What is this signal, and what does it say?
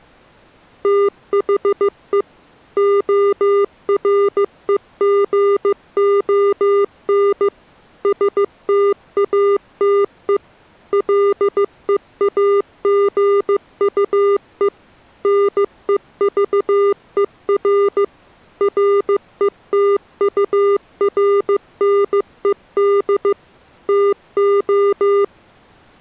Morse code, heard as electronic beeps, machine-sent, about 15 wpm, 400 Hz. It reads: THE OREGON STATE LEAGUE NEVER RETURNED TO